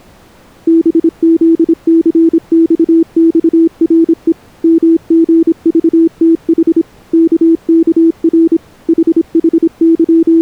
Morse code, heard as a keyed tone, machine-sent, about 26 wpm, 330 Hz. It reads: BZCXXRE MGVTH KKR …